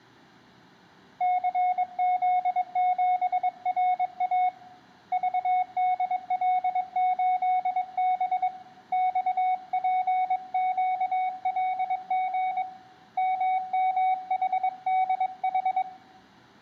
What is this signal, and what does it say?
Morse code, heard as a keyed tone, hand-sent with a paddle, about 22 wpm, 740 Hz, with room echo. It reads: CZ7RA VDL8B XPQLG MMHDH